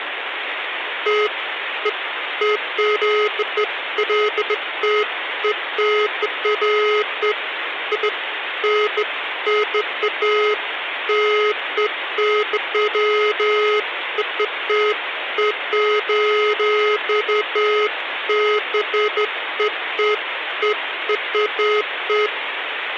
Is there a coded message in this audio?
No, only beeps of irregular length, with phone line noise.